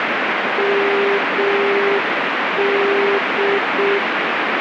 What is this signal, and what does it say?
Morse code, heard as a keyed tone, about 6 wpm, 400 Hz, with heavy radio static. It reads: MD